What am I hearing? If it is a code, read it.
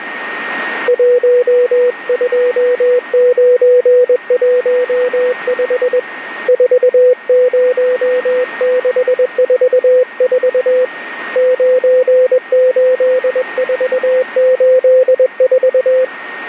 Morse code, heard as a keyed tone, hand-sent with a paddle, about 21 wpm, 500 Hz, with radio static and a steady whistle near 1850 Hz. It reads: 12915 40644 98484